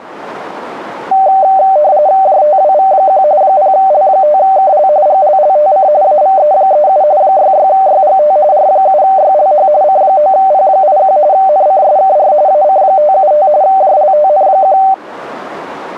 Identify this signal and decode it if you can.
RTTY (45.45 baud, 170 Hz shift), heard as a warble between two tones, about 680 Hz centre. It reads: JTWV1 0L5KL GLLTC AVE37 66YGT R7YLH C9P81 NCSKR AC575 JLTN1